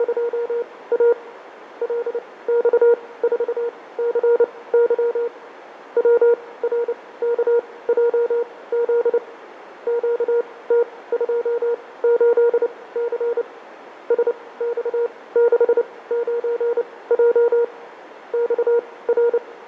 Morse code, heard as a keyed tone, machine-sent, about 29 wpm, spaced as for 19 wpm, 470 Hz, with radio static, fading and a narrow filter. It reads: … LX4CY WRKJZ QT28C SX69J …